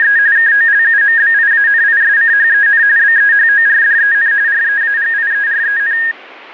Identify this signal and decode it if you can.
RTTY (45.45 baud, 170 Hz shift), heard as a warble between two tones, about 1750 Hz centre. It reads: … KOLUMBIANISCHEN BEHORDEN REAGIEREN